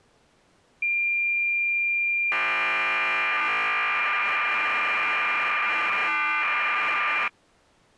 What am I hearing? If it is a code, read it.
Cassette data (Kansas City type), 1200 baud, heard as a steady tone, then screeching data.